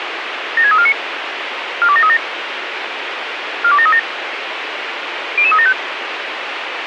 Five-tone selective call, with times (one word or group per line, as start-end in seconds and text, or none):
0.6-0.9 76349
1.8-2.2 42737
3.6-4.0 42737
5.4-5.7 00375